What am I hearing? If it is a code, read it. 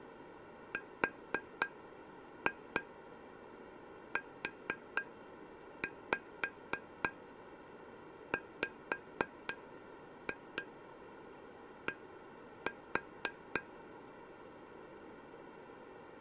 Tap code, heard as taps on glass, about 3 knocks a second. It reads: RUWD